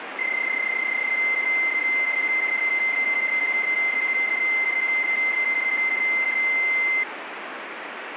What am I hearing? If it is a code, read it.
PSK31 (31.25 baud), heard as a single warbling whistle, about 2100 Hz, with radio static.